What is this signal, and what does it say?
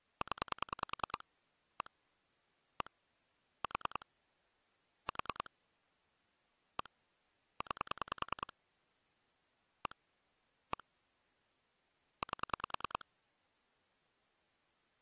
Pulse dialling, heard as clicks on a phone line, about 10 pulses a second. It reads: 0 1 1 4 4 1 9 1 1 8